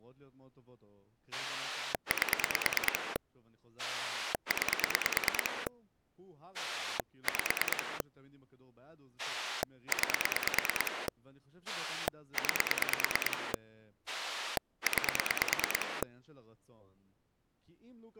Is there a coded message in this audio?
Yes: pulse dialling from 1.3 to 16.0 s, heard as a rotary dial, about 9 pulses a second, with speech in Hebrew. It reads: 8 9 5 9 9 9